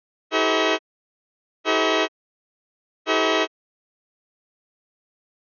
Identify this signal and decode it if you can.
Train horn signal, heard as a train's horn. 3 short. On North American railways: when stopped, the train will back up.